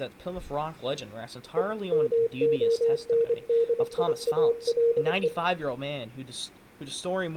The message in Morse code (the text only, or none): E MONDIALE